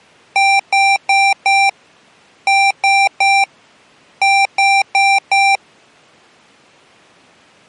Beep code, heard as beeps from a small speaker, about 790 Hz. 4-3-4. In Phoenix BIOS tables: time-of-day clock failure.